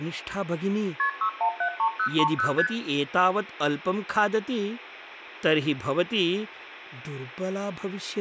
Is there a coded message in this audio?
Yes: multi-frequency trunk signalling (R1, as on North American trunks) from 1.0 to 2.7 s, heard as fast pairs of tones, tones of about 80 ms, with room echo and speech in Sanskrit. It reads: KP 6173030 ST